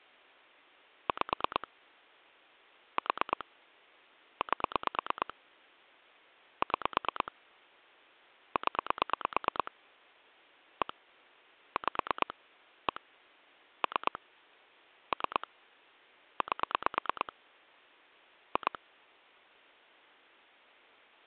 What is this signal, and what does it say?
Pulse dialling, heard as clicks on a phone line, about 9 pulses a second. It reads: 5 4 8 6 0 1 5 1 3 3 8 2